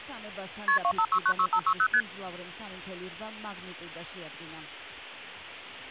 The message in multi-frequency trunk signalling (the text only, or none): KP 25696560 ST